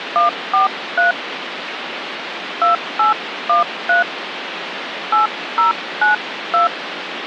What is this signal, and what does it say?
DTMF, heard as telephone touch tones, dialled by hand, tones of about 140 ms, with phone line noise. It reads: 143 2813 8092